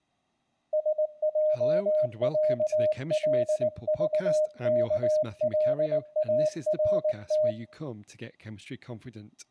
Morse code (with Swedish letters), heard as a keyed tone, hand-sent with a paddle, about 19 wpm, 610 Hz, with room echo and speech in English. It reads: SJÄLVKLART